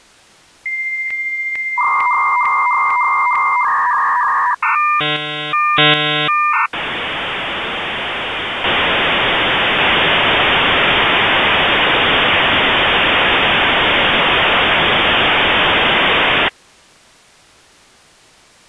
Dial-up modem handshake (V.34 or later), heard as a whistle, warbles, then hiss.